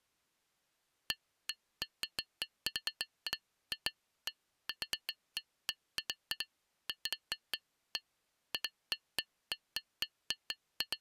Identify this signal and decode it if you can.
Irregular taps on glass. There is no code.